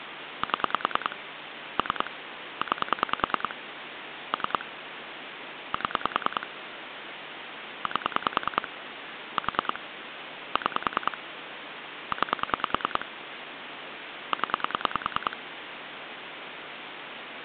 Pulse dialling, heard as clicks on a phone line, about 10 pulses a second, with phone line noise. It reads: 7 3 9 3 7 8 4 6 9 0